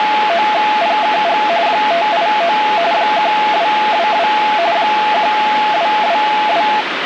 RTTY (45.45 baud, 170 Hz shift), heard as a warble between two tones, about 770 Hz centre, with radio static. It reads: … 589 1222 1222